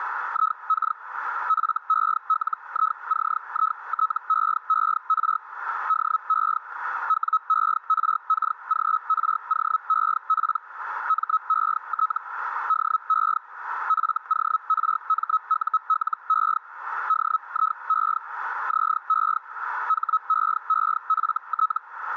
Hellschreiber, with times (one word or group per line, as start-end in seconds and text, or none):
0.3-1.0 IK
1.5-5.4 FELICITEER
5.9-6.6 DE
7.1-10.6 WERKGROEP
11.1-12.2 MET
12.7-13.4 DE
13.9-16.6 FORMULE
17.1-18.2 DIE
18.7-19.4 ZE
19.9-21.8 HEEFT